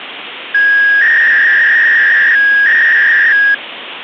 300-baud modem data (V.21 tones), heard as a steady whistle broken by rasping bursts, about 300 baud, 200 Hz shift, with phone line noise.